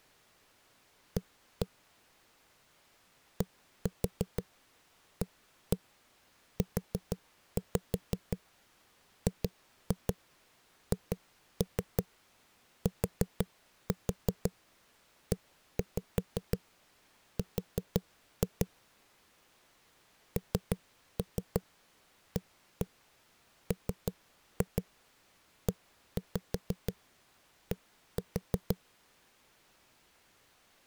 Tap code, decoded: A DAUGHTER NAMED

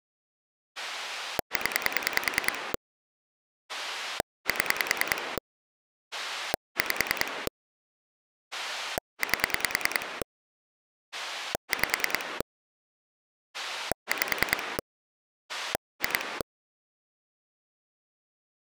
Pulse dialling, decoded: 0 7 5 8 5 5 2

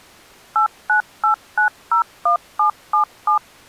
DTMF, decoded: 898901777

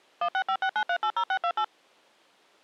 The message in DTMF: 16569380628

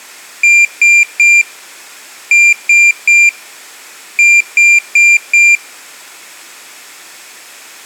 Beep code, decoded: 3-3-4

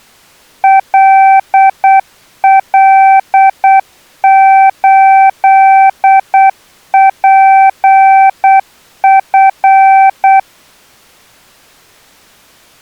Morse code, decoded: LL8PF

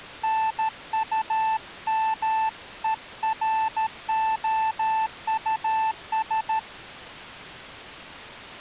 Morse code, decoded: NUMEROUS

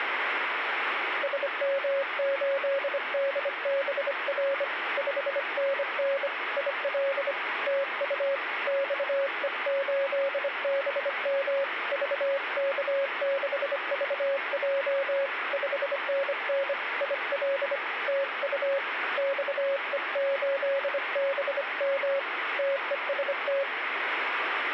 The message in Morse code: SM8DBR 5NN IL TU XE8BM VK6VJ 5NN IL TU XE8BM TEST

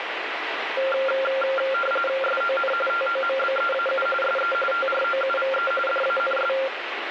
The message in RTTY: SON TOMBEAU SE TROUVE DANS

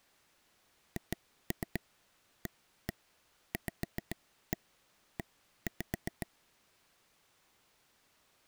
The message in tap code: HAVE

